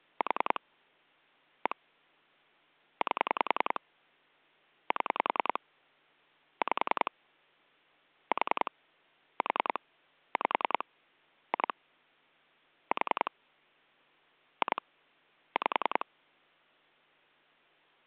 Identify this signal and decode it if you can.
Pulse dialling, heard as clicks on a phone line, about 10 pulses a second. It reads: 4 1 8 7 5 4 4 5 2 4 2 5